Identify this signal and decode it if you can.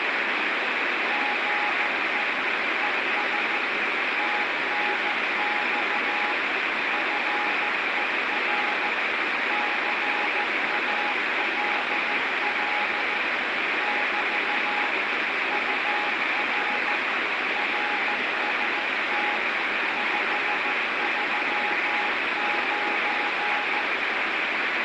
Morse code, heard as a keyed tone, machine-sent, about 14 wpm, 830 Hz, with heavy radio static. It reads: GE ES TNX FER CALL <BT> UR RST 539